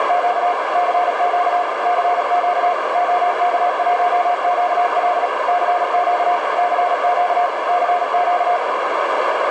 Morse code, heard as a keyed tone, machine-sent, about 37 wpm, 710 Hz, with heavy radio static and a narrow filter. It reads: … CQ CQ OK1QL CQ CQ CQ